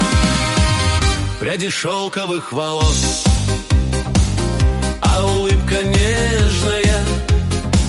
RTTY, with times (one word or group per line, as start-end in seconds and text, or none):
none